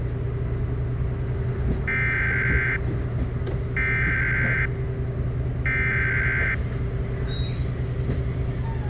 Emergency Alert System (SAME) tones (header bursts), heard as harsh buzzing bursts, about 520.83 baud, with the noise inside a bus.